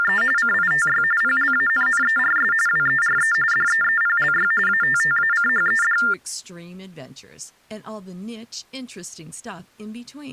TTY/TDD text telephone tones (45.45 baud Baudot), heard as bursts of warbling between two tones, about 400 Hz shift, 1600 Hz centre, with speech in English. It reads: … CITY PLANNERS WERE DEEPLY ATTACHED